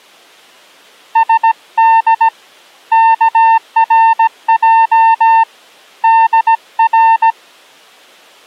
Morse code (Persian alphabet), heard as a keyed tone, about 17 wpm, 900 Hz. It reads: سد کرج در